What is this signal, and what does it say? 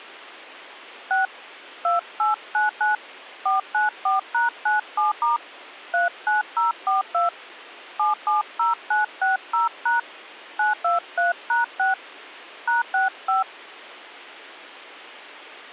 DTMF, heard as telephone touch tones, dialled by hand, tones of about 150 ms. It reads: 6 2899 494#97* 39042 770960# 923#6 #65